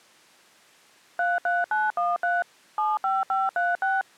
DTMF, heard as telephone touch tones, dialled by machine, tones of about 190 ms. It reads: 33913 75536